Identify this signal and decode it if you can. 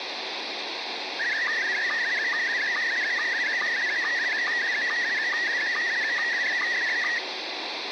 SSTV (slow-scan television), Scottie S1, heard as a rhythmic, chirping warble, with radio hiss and room echo.